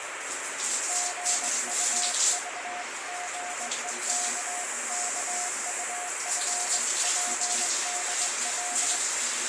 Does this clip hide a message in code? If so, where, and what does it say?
Yes: Morse code (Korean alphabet) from 0.8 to 9.0 s, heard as a keyed tone, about 21 wpm, 720 Hz, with heavy radio static and the noise of a restroom. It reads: 실상인즉